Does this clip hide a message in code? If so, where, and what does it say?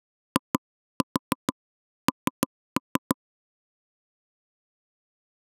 Yes: tap code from 0.4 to 3.1 s, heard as knocks on wood, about 6 knocks a second. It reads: IN